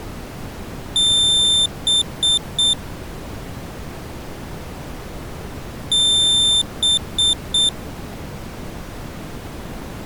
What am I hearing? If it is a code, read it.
Beep code, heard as a piezo beeper, played twice, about 3550 Hz. 1 long, 3 short. In Award and IBM BIOS tables: video adapter failure; in AMI BIOS tables: memory failure.